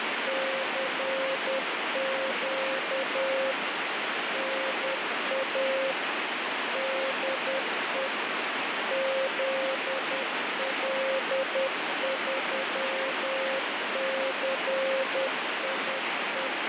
Morse code, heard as a keyed tone, machine-sent, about 10 wpm, 530 Hz, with heavy radio static. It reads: CQ NA DE ZL3CIE